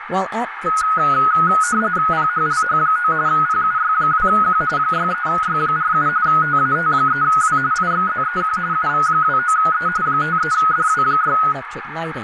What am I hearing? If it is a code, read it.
RTTY (45.45 baud, 170 Hz shift), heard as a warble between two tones, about 1360 Hz centre, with radio static, a narrow filter, room echo and speech in English. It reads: PHLH9 PUY2Q 63Y47 TAT3W IXZEQ UV29E 53DW6